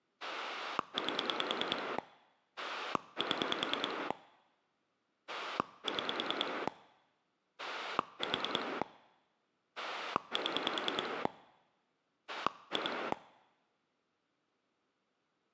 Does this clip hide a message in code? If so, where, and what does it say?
Yes: pulse dialling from 0.2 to 13.1 s, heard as a rotary dial, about 10 pulses a second. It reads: 8 7 6 4 7 2